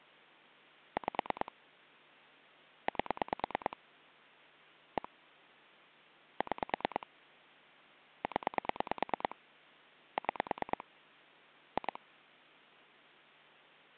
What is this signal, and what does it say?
Pulse dialling, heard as clicks on a phone line, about 9 pulses a second. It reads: 5 8 1 6 0 6 2